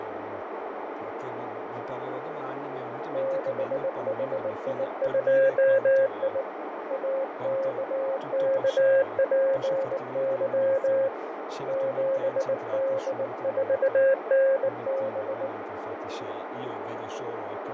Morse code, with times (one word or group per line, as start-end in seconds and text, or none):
3.1-6.4 6HI2I
6.9-11.1 AKKPY
11.7-15.5 7D4NB